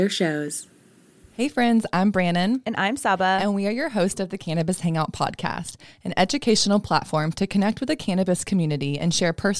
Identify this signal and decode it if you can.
Speech in English. There is no code.